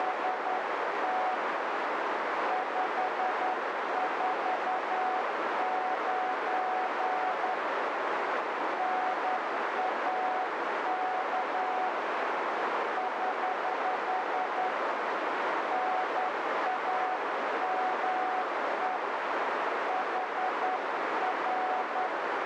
Morse code, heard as a keyed tone, hand-sent with a straight key, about 10 wpm, 740 Hz, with heavy radio static and a narrow filter. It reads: … 549 NAK <HH> NAME HR